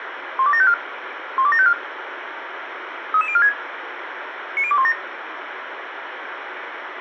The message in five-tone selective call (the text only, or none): 12754 12754 33046 90217